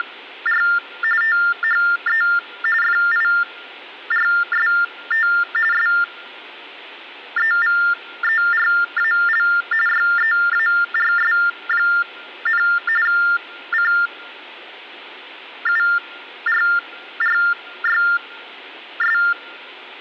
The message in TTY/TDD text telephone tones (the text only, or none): … THE FIRST SEVERAL YEARS, CURRYS